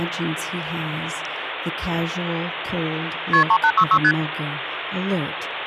Multi-frequency trunk signalling (R1, as on North American trunks), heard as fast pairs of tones, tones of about 70 ms, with phone line noise. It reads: KP 3866 ST